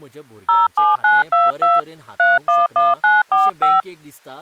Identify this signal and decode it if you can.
DTMF, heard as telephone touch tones, dialled by hand, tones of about 180 ms, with speech in Goan Konkani. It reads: 07922 311945